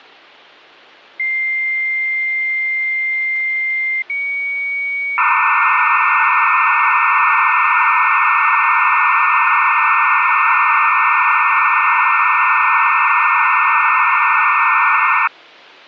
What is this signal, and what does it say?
Dial-up modem handshake (low-speed, two carriers), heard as two whistles, then hiss.